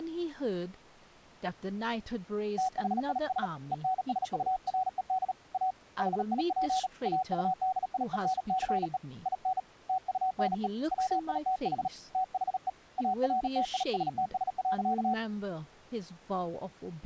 Morse code, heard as a keyed tone, hand-sent with a bug key, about 37 wpm, 750 Hz, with speech in English. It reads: THIS ENSURED A HIP AUDIENCE IN TUNE WITH THE ARTISTS.